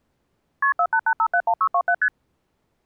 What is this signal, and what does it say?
Multi-frequency trunk signalling (R1, as on North American trunks), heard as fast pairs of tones, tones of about 70 ms. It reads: KP 488571627 ST